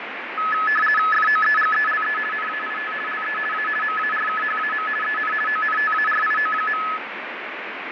RTTY (50 baud, 450 Hz shift), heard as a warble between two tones, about 1500 Hz centre, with radio static and fading. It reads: FOEGELE NAIT LE A MARKHAM EN ONTARIO.